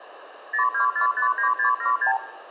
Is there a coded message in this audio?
Yes: multi-frequency trunk signalling (R2, with the far end's replies) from 0.5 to 2.2 s, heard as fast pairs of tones, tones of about 110 ms, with hum and room echo. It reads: 02459676